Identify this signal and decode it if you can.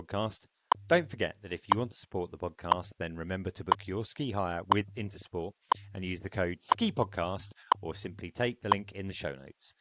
Radio time signal (WWV, Colorado), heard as ticks, one a second, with speech in English.